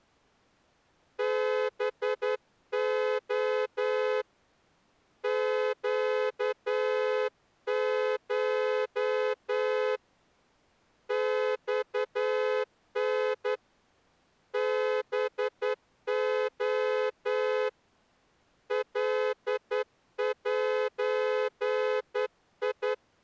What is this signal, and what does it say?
Morse code (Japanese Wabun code), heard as a horn, hand-sent with a straight key, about 10 wpm. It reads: ハレ ネコ マタ ハレ カゼ